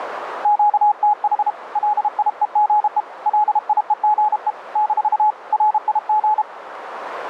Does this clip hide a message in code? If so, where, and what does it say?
Yes: Morse code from 0.4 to 6.5 s, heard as a keyed tone, hand-sent with a paddle, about 32 wpm, 840 Hz, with radio static. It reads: QTH LIEGE LIEGE - RIG